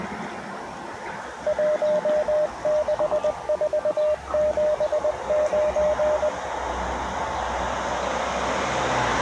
Morse code, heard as a keyed tone, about 20 wpm, 610 Hz, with the noise of a residential street. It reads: 16479